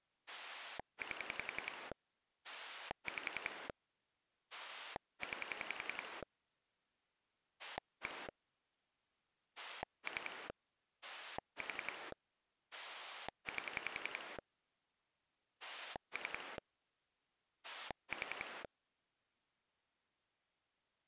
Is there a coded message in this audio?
Yes: pulse dialling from 0.3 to 18.7 s, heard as a rotary dial, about 11 pulses a second. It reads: 8 5 9 1 3 4 8 3 4